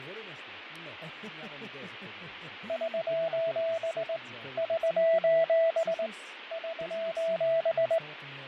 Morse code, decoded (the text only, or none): <SOS> <SOS> <SOS>